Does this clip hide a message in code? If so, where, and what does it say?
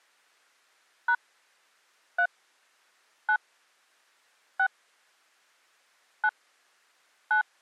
Yes: DTMF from 1.1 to 7.4 s, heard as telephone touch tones, dialled by hand, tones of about 80 ms. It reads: # 3 9 6 9 9